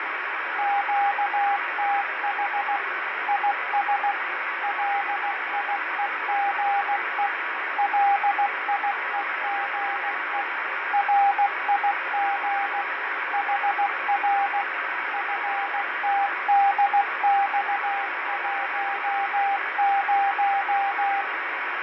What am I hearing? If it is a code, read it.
Morse code, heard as a keyed tone, machine-sent, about 16 wpm, 800 Hz, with heavy radio static and fading. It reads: QTH IS LIEGE LIEGE RIG HR FTDX10